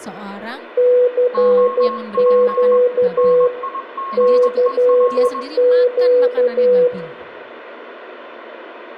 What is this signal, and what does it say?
Morse code, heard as two keyed tones, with radio static, room echo and speech in Indonesian. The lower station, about 12 wpm, 500 Hz: CQ CQ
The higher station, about 21 wpm, 1080 Hz: OP NIGEL